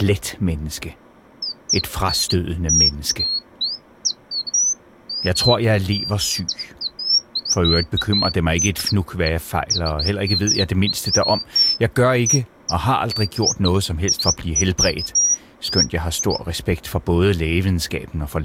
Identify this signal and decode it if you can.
Bird-like chirps, with speech in Danish. There is no code.